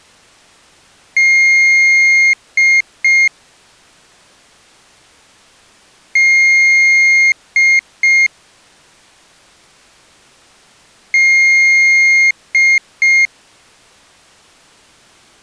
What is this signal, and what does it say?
Beep code, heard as a piezo beeper, played three times, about 2150 Hz. 1 long, 2 short. In Award, IBM and AMI BIOS tables: video adapter failure.